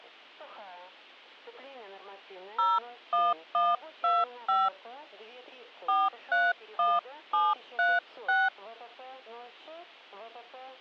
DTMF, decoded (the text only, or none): 01125 431736